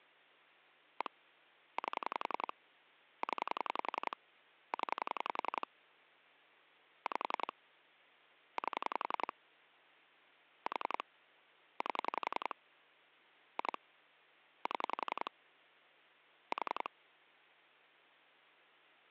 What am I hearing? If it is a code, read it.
Pulse dialling, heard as clicks on a phone line, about 11 pulses a second, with hum. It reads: 1 8 0 0 5 8 4 8 2 7 4